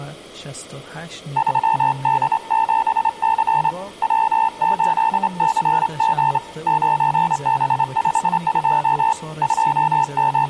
Morse code, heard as a keyed tone, hand-sent with a straight key, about 28 wpm, 890 Hz, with room echo and speech in Persian. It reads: 3D7C W8CG 9B52 …